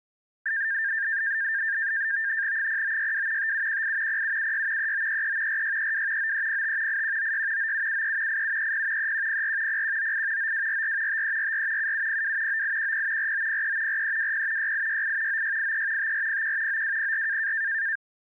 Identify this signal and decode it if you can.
NAVTEX (SITOR-B), 100 baud, 170 Hz shift, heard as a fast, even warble, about 1700 Hz centre. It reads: 0962 5718 0776 3933 4632 9305 8196 9773 8730 3104 0198 9244 5344 7702 9810 4903 4320 6868 9683 5401 9204